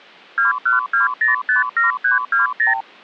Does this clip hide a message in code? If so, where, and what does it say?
Yes: multi-frequency trunk signalling (R2, with the far end's replies) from 0.4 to 2.8 s, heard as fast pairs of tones, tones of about 140 ms. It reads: 212057320